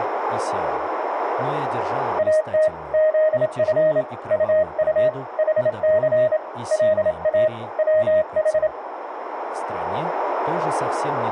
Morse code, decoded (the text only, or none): AT ZF UU HC LA WH